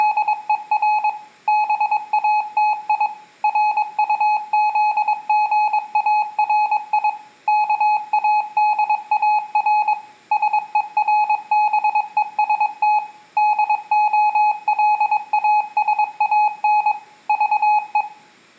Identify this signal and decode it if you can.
Morse code, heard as a keyed tone, machine-sent, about 22 wpm, 850 Hz, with room echo. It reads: … BATI RUZGARI KADAR SERBEST DOLASAN VE